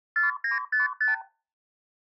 Multi-frequency trunk signalling (R2, with the far end's replies), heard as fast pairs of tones, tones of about 140 ms. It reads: 4955